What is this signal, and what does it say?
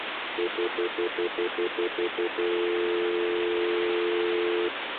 Telephone call progress tone (North American plan), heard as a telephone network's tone, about 350, 440 Hz, 0.1 s on and 0.1 s off, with phone line noise. Stutter dial tone.